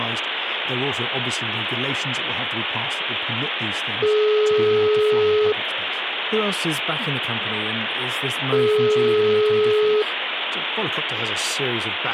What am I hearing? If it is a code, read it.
Telephone call progress tone (single-tone plan, as in most of Europe), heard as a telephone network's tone, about 420 Hz, 1.5 s on and 3 s off, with phone line noise and speech in English. Ringback tone.